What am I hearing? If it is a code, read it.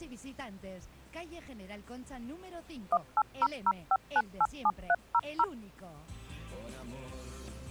DTMF, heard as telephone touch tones, dialled by machine, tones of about 50 ms. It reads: 18005987300